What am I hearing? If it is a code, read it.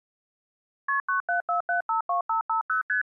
Multi-frequency trunk signalling (R1, as on North American trunks), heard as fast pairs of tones, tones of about 120 ms. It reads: KP 974752550 ST